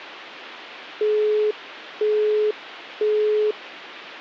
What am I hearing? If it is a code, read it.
Telephone call progress tone (single-tone plan, as in Europe, Japan and elsewhere), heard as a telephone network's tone, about 420 Hz, 0.5 s on and 0.5 s off. Busy tone.